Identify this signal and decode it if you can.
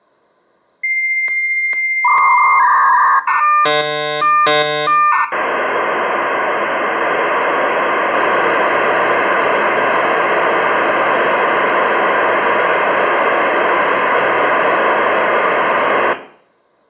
Dial-up modem handshake (V.34 or later), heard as a whistle, warbles, then hiss, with room echo.